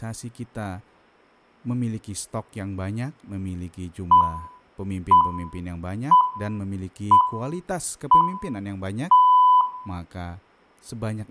Radio time signal (six pips, as the Greenwich Time Signal), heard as pips, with room echo and speech in Indonesian.